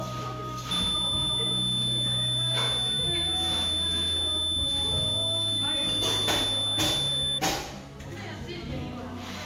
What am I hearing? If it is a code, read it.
A steady tone, with the noise of a cafe. There is no code.